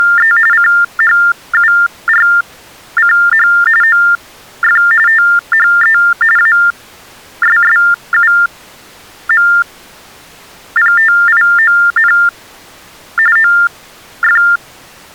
TTY/TDD text telephone tones (45.45 baud Baudot), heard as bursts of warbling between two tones, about 400 Hz shift, 1600 Hz centre. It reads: … CHURCH OF THE ASSUMPTION OF